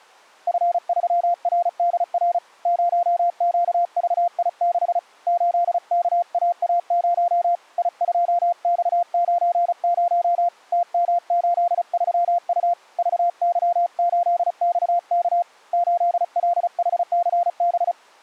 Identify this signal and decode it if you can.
Morse code, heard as a keyed tone, hand-sent with a paddle, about 35 wpm, 700 Hz. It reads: F3RDR 0QVI6 8KAA0 I2X90 TM83U VY8XK 8LHCB